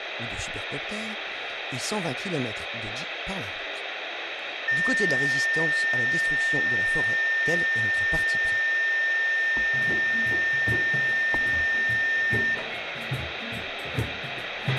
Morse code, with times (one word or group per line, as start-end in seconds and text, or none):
none